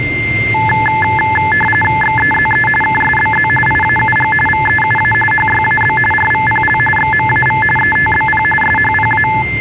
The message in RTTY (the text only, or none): XEZE KSBZ IAUG VEUA HYAB RVPL XMAV ETBP SHPA